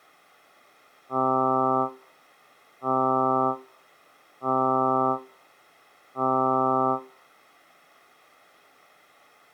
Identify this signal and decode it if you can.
Ship horn signal, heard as a ship's horn, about 130 Hz. 4 short. At sea: a pilot vessel's identity signal in fog.